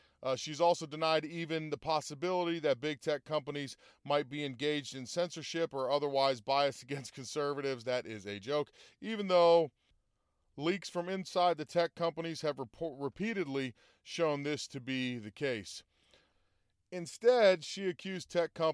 Speech in English. There is no code.